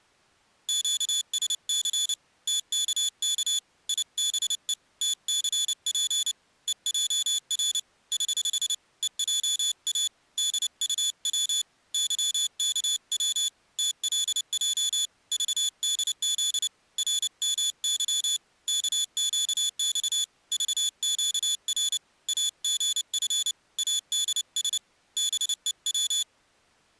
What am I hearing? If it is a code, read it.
Morse code, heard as a high beeper, hand-sent with a paddle, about 29 wpm, 3450 Hz. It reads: QSC TKK IBE TCP EJR <HH> EJA DUW YKW TLJ VDZ RMY KQX VQR AGF ADS BEW